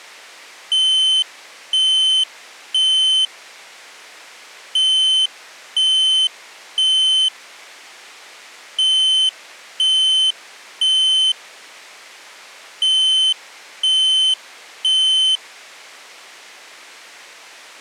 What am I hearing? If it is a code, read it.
Alarm pattern, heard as an alarm's beeps, played four times, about 3050 Hz. Temporal three. Smoke or fire, evacuate.